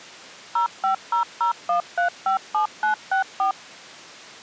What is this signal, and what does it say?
DTMF, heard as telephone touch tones, dialled by machine, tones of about 110 ms. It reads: 05001357964